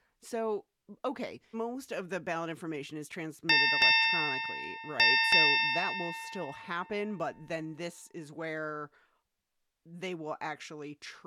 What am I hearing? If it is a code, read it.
Ship's bell, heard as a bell, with speech in English. 4. Four half-hours of the watch have passed.